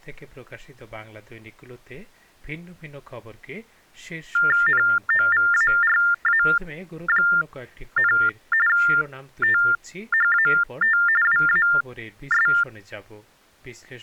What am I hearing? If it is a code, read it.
TTY/TDD text telephone tones (45.45 baud Baudot), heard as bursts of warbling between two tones, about 400 Hz shift, 1600 Hz centre. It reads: NOVARA, THAT WAS